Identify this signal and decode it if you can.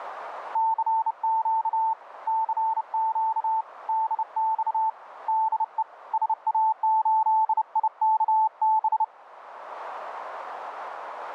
Morse code, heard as a keyed tone, hand-sent with a bug key, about 30 wpm, 880 Hz, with radio static. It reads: CQ CQ DX DE SA8IKB